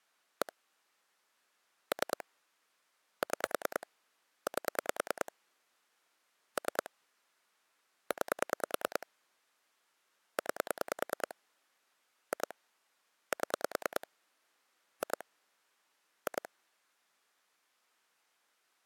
Pulse dialling, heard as clicks on a phone line, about 9 pulses a second. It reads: 1 3 6 8 3 9 9 2 7 2 2